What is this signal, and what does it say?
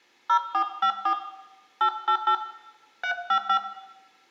DTMF, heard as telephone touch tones, dialled by hand, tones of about 80 ms, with room echo. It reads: 0454 888 355